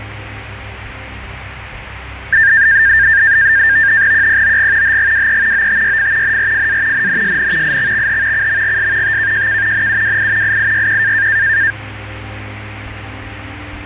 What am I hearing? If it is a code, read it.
NAVTEX (SITOR-B), 100 baud, 170 Hz shift, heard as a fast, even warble, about 1700 Hz centre, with radio static. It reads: QPOG HGWE OTYF NRFA NNSN IXXH CMGS TKJK NUWI IIYQ